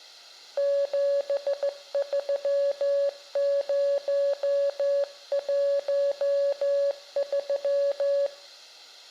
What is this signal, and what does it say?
Morse code, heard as a keyed tone, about 15 wpm, 560 Hz, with room echo. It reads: 73013